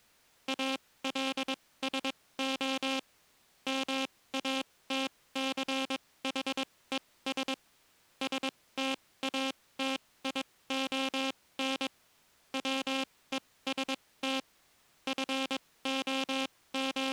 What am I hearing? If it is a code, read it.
Morse code, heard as a buzzer, machine-sent, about 22 wpm, spaced as for 17 wpm. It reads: ALSO MATCHES STATION WEST …